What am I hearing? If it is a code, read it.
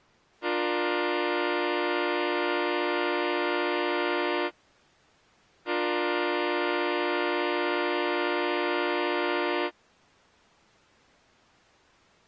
Train horn signal, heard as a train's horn. 2 long. On North American railways: brakes released, proceed.